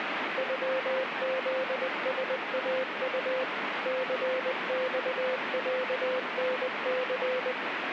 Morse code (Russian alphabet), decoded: ЮЗСАУ ЦЬЯНЦ

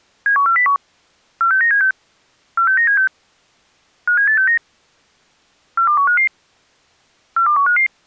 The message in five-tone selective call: 71401 46976 46976 57869 42155 42155

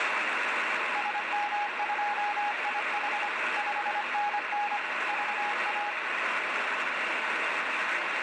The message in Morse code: SM2IH 5NN VA

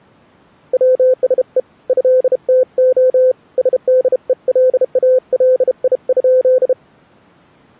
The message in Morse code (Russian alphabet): ВСЕ ЭТО СДЕЛАЛИ?

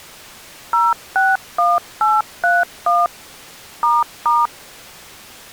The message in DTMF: 061831 **

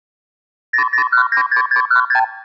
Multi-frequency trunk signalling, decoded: 00196616

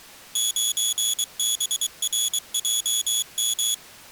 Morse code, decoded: 9BRJM

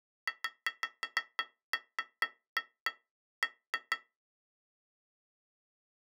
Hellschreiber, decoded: none

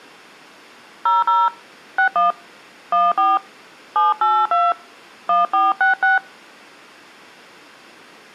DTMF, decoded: 00 61 14 782 1466

